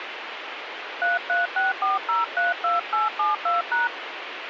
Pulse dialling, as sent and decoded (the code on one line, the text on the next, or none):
none